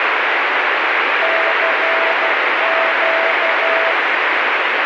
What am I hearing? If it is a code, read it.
Morse code, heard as a keyed tone, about 12 wpm, 660 Hz, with heavy radio static. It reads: CQ